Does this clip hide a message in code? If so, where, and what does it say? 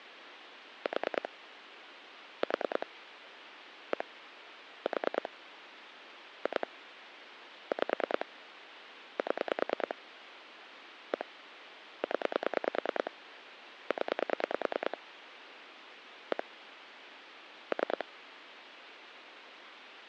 Yes: pulse dialling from 0.9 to 18.0 s, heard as clicks on a phone line, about 9 pulses a second, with phone line noise. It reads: 4 4 1 4 2 5 7 1 0 0 1 3